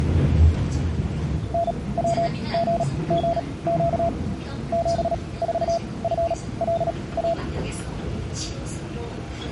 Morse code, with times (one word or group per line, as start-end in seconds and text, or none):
1.5-4.1 NWGGQ
4.7-7.3 74FLA